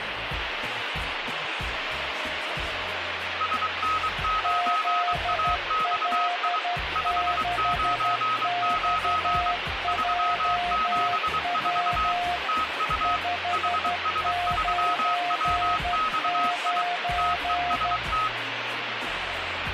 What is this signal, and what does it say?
Morse code, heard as two keyed tones, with radio static. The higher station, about 23 wpm, 1270 Hz: SN9AXI 599 374 TU HS3WXI TEST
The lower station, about 12 wpm, 710 Hz: ZL6XJW 599